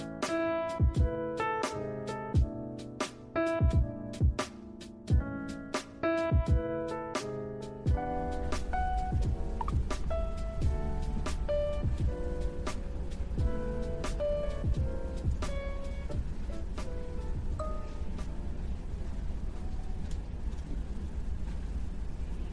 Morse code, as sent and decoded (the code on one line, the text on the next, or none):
none